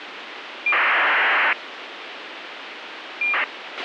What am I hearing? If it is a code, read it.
ACARS aircraft data, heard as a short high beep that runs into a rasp, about 2400 baud, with radio hiss and a squelch burst at the end.